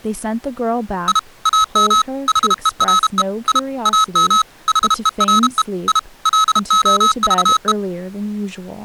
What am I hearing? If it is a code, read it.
Morse code, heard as electronic beeps, machine-sent, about 32 wpm, 1280 Hz, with speech in English. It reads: I AM HERE I AM HERE I LOVE